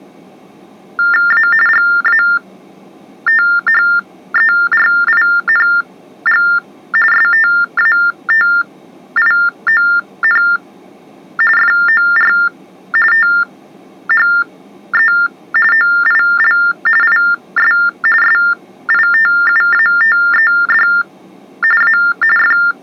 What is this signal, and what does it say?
TTY/TDD text telephone tones (45.45 baud Baudot), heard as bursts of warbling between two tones, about 400 Hz shift, 1600 Hz centre. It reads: A GATHERING STATION FOR THE OIL IS SITUATED A …